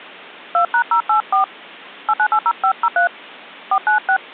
DTMF, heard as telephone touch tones, dialled by hand, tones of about 80 ms. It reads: 2#084 8980503 496